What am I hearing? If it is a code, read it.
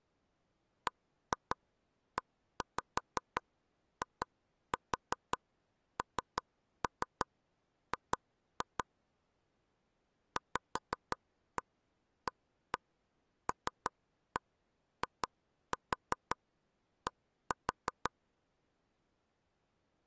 Tap code, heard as taps on a table, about 5 knocks a second. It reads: BEING VALID